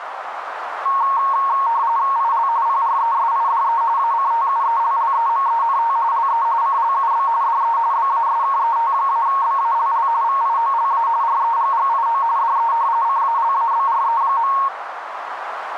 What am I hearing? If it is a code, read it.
RTTY (45.45 baud, 170 Hz shift), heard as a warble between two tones, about 1010 Hz centre, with radio static and a narrow filter. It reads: IL PRESIDE ACTUELLEMENT LE CLUB DE BASKET-BALL VIOLA REGGIO DE CALABRE.